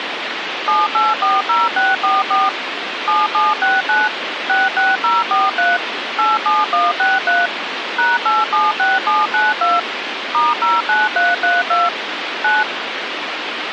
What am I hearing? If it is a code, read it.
DTMF, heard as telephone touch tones, dialled by machine, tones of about 190 ms, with phone line noise. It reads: 7840644 7769 66043 87163 #876792 *09332 9